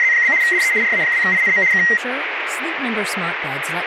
RTTY (75 baud, 170 Hz shift), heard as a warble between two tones, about 2000 Hz centre, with radio static and speech in English. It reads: … DE RA2INM K